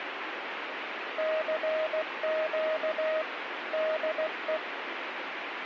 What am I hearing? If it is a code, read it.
Morse code, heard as a keyed tone, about 16 wpm, 630 Hz, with radio static. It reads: CQ DE